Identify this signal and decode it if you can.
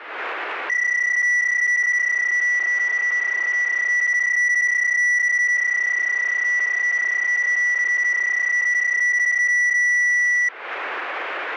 PSK31 (31.25 baud), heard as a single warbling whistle, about 1950 Hz, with radio static.